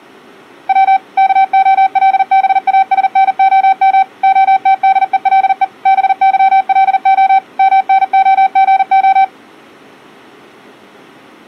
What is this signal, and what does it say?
Morse code (Russian alphabet), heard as a keyed tone, machine-sent, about 40 wpm, 770 Hz. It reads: В КОЛБАСНОМ ОТДЕЛЕ БЫЛО МНОГО